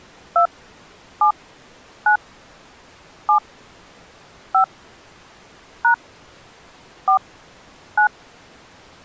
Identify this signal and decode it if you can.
DTMF, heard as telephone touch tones, dialled by hand, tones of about 100 ms. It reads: 2 7 9 7 5 # 4 9